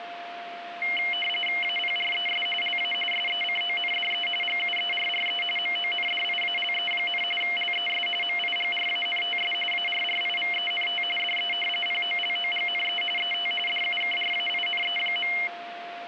RTTY (45.45 baud, 850 Hz shift), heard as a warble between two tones, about 2550 Hz centre, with radio static and a steady whistle near 700 Hz. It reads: APRES LA SECONDE GUERRE MONDIALE, LES MIGRANTS ARRIVENT DE POLOGNE ET DUKRAINE.